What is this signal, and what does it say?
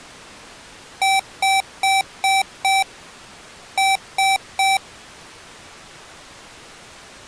Beep code, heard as beeps from a small speaker, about 770 Hz. 5-3.